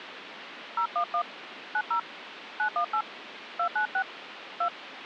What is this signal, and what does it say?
DTMF, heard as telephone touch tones, dialled by hand, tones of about 80 ms, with phone line noise. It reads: 011 90 918 296 2